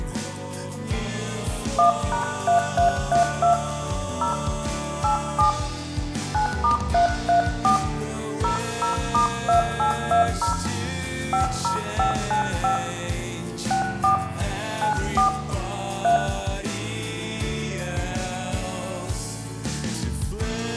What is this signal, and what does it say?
DTMF, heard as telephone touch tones, dialled by hand, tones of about 120 ms, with room echo. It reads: 1#3332 0 87 9*334 00*2820 50595 64 94 3